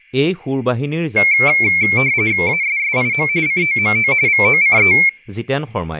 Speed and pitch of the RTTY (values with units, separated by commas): 45.45 baud, 170 Hz shift, 2250 Hz centre